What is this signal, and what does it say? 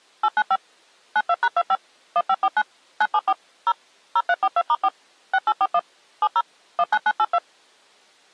DTMF, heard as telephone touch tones, dialled by machine, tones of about 50 ms. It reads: 895 92#25 1549 974 0 0342*4 6841 70 19982